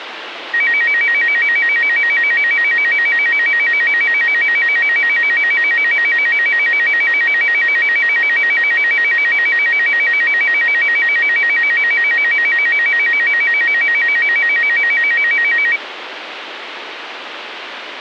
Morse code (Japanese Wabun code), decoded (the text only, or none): none